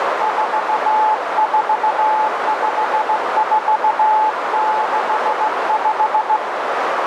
Morse code, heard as a keyed tone, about 16 wpm, 860 Hz, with heavy radio static and a narrow filter. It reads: 445465